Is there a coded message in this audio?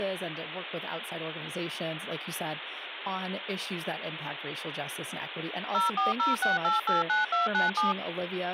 Yes: DTMF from 5.7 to 7.9 s, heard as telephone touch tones, dialled by machine, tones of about 150 ms, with phone line noise and speech in English. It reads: 0406889297